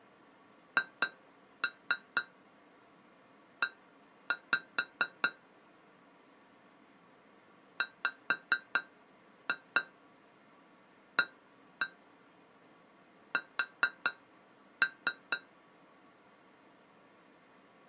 Tap code, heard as taps on glass, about 4 knocks a second. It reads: HE WAS